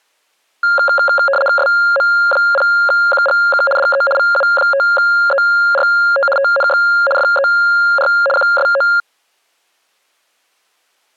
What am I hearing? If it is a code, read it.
RTTY (75 baud, 850 Hz shift), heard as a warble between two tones, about 980 Hz centre. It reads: SM0QGK DE VU5ERT TNX FER QSO